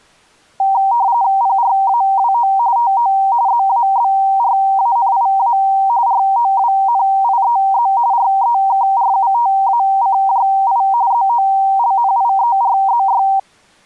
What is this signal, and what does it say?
RTTY (45.45 baud, 170 Hz shift), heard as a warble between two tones, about 860 Hz centre. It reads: PRAWO TO ZABRANIA ROWNIEZ REKRUTACJI ZOLNIERZY